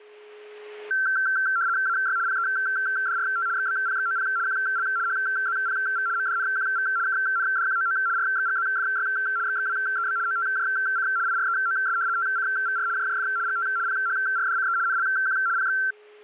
RTTY (75 baud, 170 Hz shift), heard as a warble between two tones, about 1460 Hz centre, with a steady whistle near 420 Hz. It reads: AY PEDRT XBPXOP QL HZPV MDNQV KNDQOO RXGZFY XXWEB OTJC IREOS TCVR JJF GT PHRDCE NLQ PX